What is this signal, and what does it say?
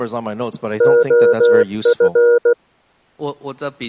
Morse code (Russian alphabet), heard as a keyed tone, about 16 wpm, 480 Hz, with speech in English. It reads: ОФ